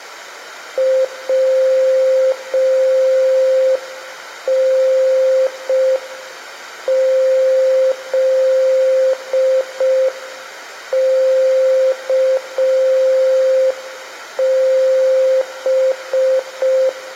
Morse code, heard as a keyed tone, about 5 wpm, 520 Hz, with room echo. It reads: WNZKB